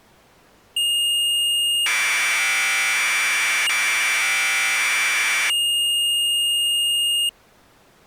Commodore tape loading (standard loader), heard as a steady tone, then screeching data.